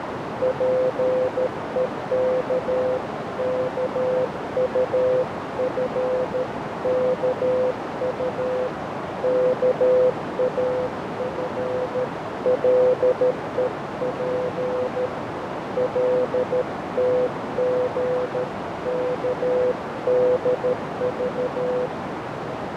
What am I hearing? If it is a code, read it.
Morse code (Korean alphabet), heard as a keyed tone, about 13 wpm, 510 Hz, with heavy radio static, fading and a narrow filter. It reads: 장인이 온갖 것을